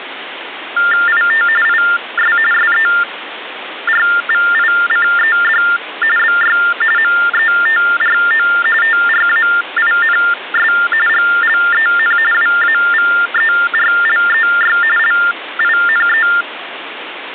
TTY/TDD text telephone tones (45.45 baud Baudot), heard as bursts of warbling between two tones, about 400 Hz shift, 1600 Hz centre, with phone line noise. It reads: IT IS SERVICED BY METRO TRAINS GLEN WAVERLEY LINE